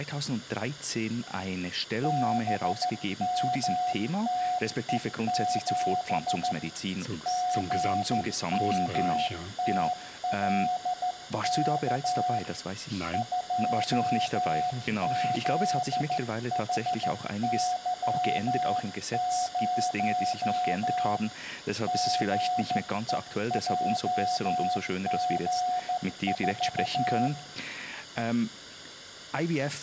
Morse code, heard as a keyed tone, hand-sent with a straight key, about 14 wpm, 730 Hz, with room echo. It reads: BMTE7 GMTLK 2ZHY0 GEJG4